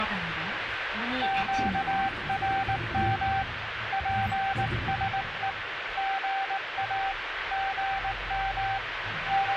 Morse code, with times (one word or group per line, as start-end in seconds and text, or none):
1.2-3.4 QRM
3.9-5.5 PSE
6.0-7.1 GA
7.5-8.8 GM